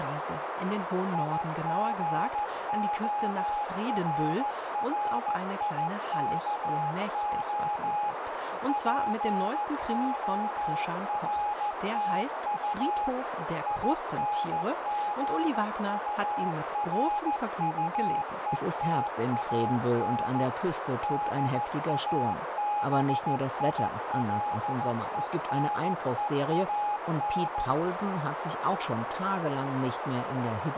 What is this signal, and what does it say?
Morse code, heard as a keyed tone, machine-sent, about 14 wpm, 830 Hz, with heavy radio static, a narrow filter and speech in German. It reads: IGORRIKO PORTU INGURUETAN DABILENEAN